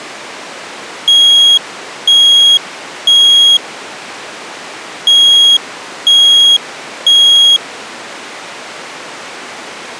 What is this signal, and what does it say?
Alarm pattern, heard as an alarm's beeps, played twice, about 3300 Hz. Temporal three. Smoke or fire, evacuate.